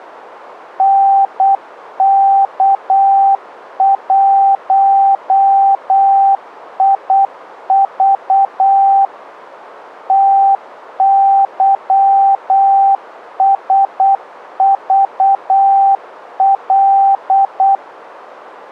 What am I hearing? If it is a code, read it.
Morse code, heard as a keyed tone, machine-sent, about 8 wpm, 780 Hz. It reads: NK1IV TYSVL